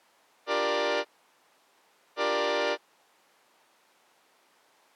Train horn signal, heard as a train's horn. 2 short. On North American railways: a signal is acknowledged.